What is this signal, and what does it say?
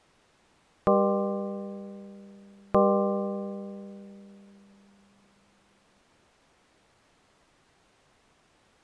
Clock strike, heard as a bell. 2. Two o'clock.